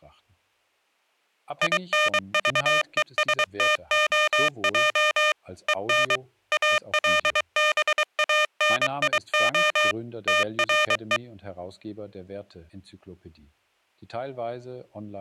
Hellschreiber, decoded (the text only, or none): none